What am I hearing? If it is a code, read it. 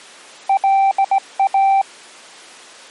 Morse code, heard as a keyed tone, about 17 wpm, 780 Hz. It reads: LA